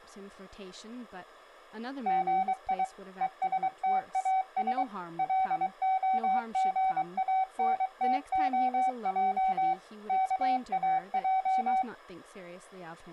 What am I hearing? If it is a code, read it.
Morse code, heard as a keyed tone, machine-sent, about 23 wpm, 760 Hz, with speech in English. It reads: GI ESTAS LOGANTOJ KAJ